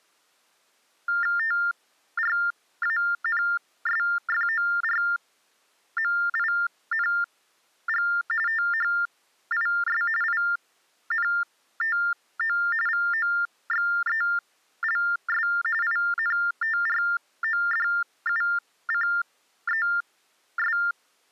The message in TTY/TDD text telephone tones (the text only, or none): TRANSFORMING THIS INTO VOXELS INTRODUCES